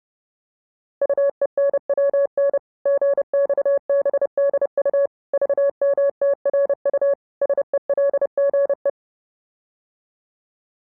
Morse code, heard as a keyed tone, machine-sent, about 30 wpm, 560 Hz. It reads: UENWN GXBDU VMTRU SELGE